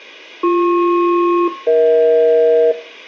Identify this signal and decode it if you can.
Aircraft SELCAL, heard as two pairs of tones, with room echo. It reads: BP-EH